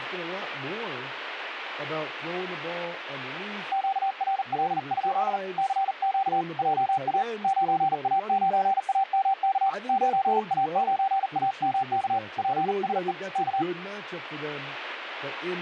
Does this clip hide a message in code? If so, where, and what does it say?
Yes: Morse code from 3.7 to 13.7 s, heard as a keyed tone, hand-sent with a paddle, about 39 wpm, 780 Hz, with radio static and speech in English. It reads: QRL? CQ JA 9A9AMK 9A9AMK PSE K